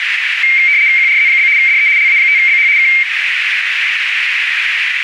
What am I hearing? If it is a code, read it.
RTTY (75 baud, 170 Hz shift), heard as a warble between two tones, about 2200 Hz centre, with radio static and a narrow filter. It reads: QRZ? DE LA5BH K